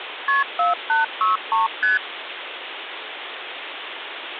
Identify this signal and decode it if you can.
Multi-frequency trunk signalling (R1, as on North American trunks), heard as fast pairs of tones, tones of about 150 ms, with phone line noise. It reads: KP 4863 ST